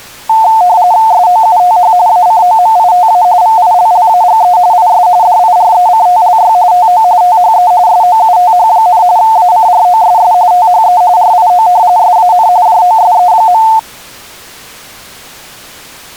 RTTY (45.45 baud, 170 Hz shift), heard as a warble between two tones, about 800 Hz centre. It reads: SOUTH ACOMITA VILLAGE IS DIRECTLY TO THE SOUTH, ACROSS THE RIO SAN JOSE.